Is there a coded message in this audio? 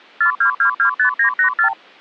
Yes: multi-frequency trunk signalling (R2, with the far end's replies) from 0.2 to 1.7 s, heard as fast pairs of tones, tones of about 100 ms. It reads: 42225984